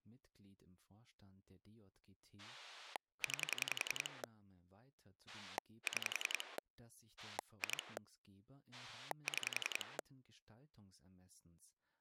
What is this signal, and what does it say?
Pulse dialling, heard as a rotary dial, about 10 pulses a second, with speech in German. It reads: 9 6 2 6